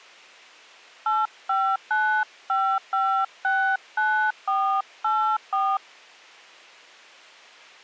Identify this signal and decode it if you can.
DTMF, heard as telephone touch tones, dialled by hand, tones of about 290 ms. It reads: 8595569484